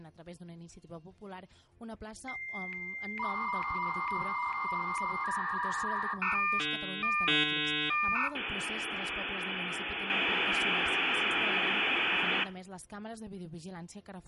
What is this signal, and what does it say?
Dial-up modem handshake (V.34 or later), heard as a whistle, warbles, then hiss, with room echo.